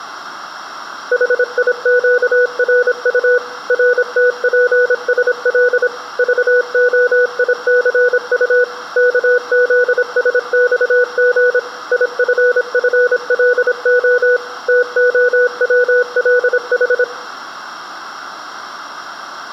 Morse code, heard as a keyed tone, machine-sent, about 26 wpm, 490 Hz, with room echo. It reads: HIQRU RTPSL VOICU KZSXG IFFLO TOWLH